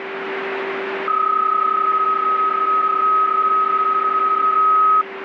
PSK31 (31.25 baud), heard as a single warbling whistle, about 1270 Hz, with radio static and a steady whistle near 390 Hz.